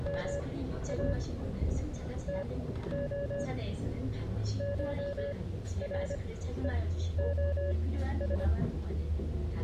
Morse code (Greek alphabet), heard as a keyed tone, machine-sent, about 25 wpm, spaced as for 13 wpm, 570 Hz, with the noise inside a bus. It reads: ΜΑ ΤΟ ΧΡΕΟΣ